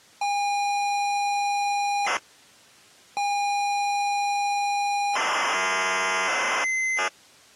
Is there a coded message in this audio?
Yes: ZX Spectrum tape loading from 0.2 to 7.1 s, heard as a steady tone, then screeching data.